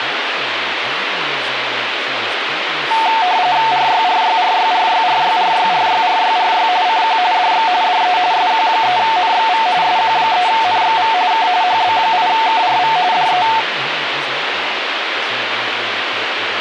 RTTY (45.45 baud, 170 Hz shift), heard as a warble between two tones, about 810 Hz centre, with radio static and speech in English. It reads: RYRYRYRYRYRYRYRYRY CQ DX DE SQ3NXV SQ3NXV K HB8KRV DE